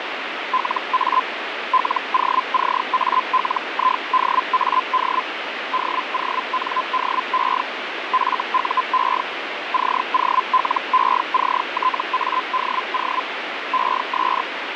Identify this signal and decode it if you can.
Hellschreiber (Feld-Hell, 122.5 baud), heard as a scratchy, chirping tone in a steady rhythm, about 1020 Hz, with radio static. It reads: LA LOCALIDAD DONDE FUE COLECTADO ES